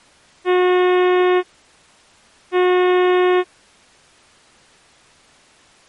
Ship horn signal, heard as a ship's horn, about 360 Hz. 2 short. At sea: I am altering course to port.